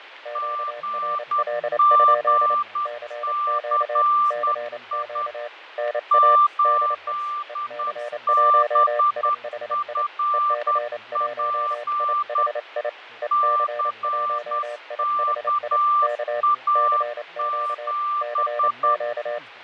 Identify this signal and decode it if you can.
Morse code, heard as two keyed tones, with radio static, fading and speech in English. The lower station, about 28 wpm, 600 Hz: QRL? CQ CQ NA DE EC1IHI EC1IHI EC1IHI K CQ CQ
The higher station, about 10 wpm, 1180 Hz: GGCI 8BFP CKA7